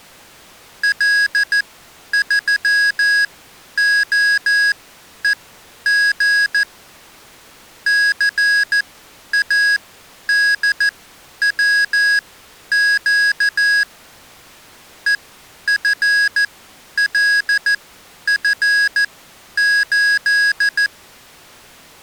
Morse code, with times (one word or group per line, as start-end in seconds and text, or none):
0.8-6.6 L3OEG
7.9-13.8 CADWQ
15.1-20.9 EFLF8